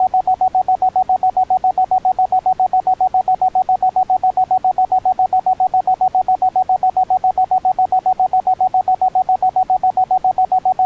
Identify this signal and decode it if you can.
Evenly repeated beeps. There is no code.